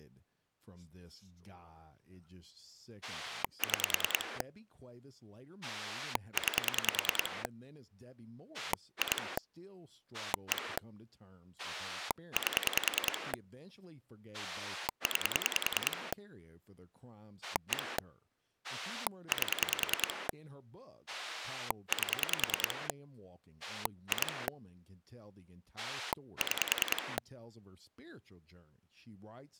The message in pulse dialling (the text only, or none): 6 9 2 1 8 9 1 8 8 2 6